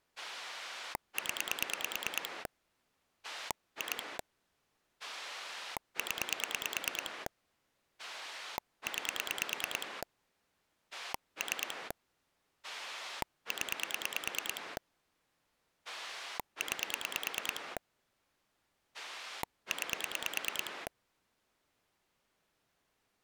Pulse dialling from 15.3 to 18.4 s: 9

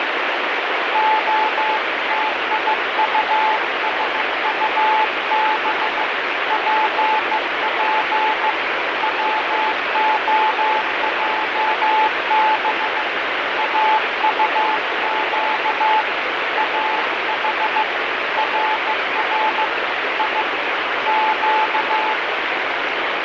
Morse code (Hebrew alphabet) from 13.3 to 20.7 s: אטק אח רר י

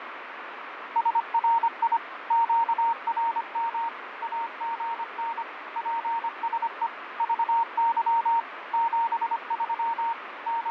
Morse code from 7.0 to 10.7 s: VY 73 …

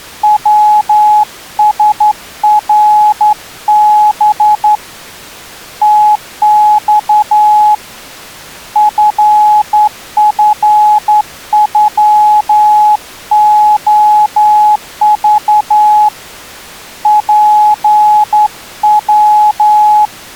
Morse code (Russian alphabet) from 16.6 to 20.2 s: ПВ

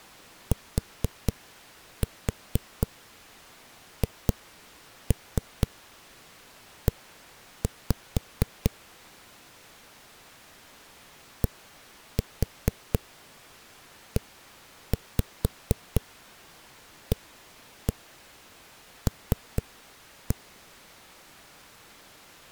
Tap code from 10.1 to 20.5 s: DEAL

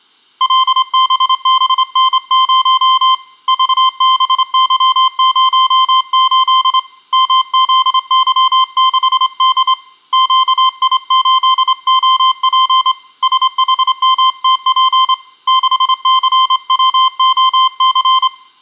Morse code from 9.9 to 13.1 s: QI8OP

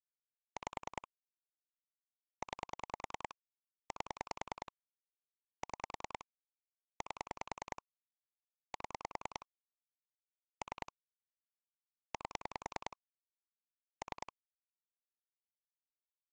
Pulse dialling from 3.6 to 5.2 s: 8

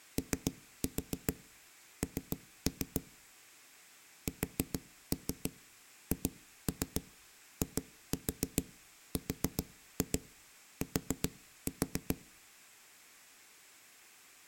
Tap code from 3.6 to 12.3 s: SHIRT

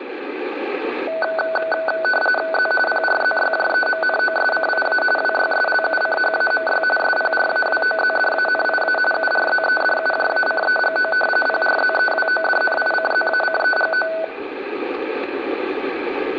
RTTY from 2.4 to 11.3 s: Z PRZYJEMNOSCIA WYSLUCHAMY SPRAWOZDANIA URZEDUJACEGO

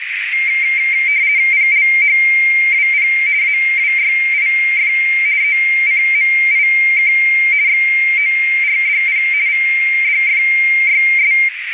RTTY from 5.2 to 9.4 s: ECMIK XORDP

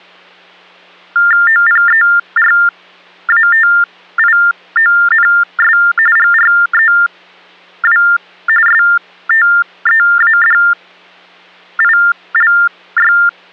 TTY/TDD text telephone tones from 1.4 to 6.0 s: OPERATIONS

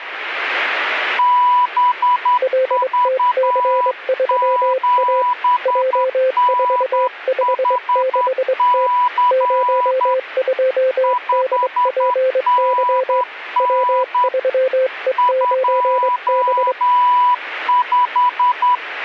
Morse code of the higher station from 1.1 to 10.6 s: BV7NHC

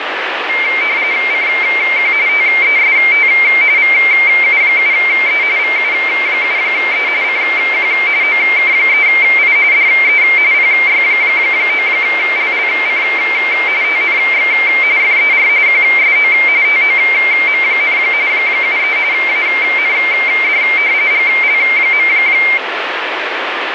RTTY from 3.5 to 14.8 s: VU7E VU7E CQ OK3I DE PY9LLC TNX

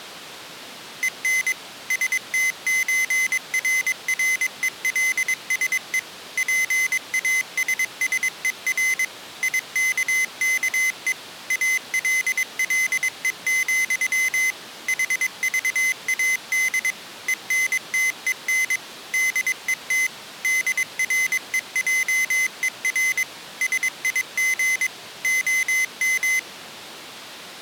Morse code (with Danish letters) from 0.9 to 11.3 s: EN STØRRELSE PASSER IKKE

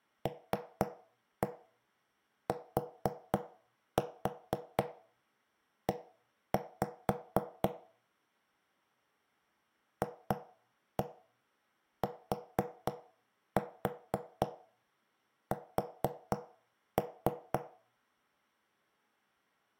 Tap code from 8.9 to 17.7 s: FTS

